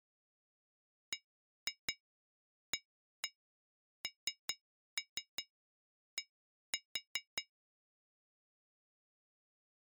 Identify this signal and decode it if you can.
Tap code, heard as taps on glass, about 5 knocks a second. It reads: BAND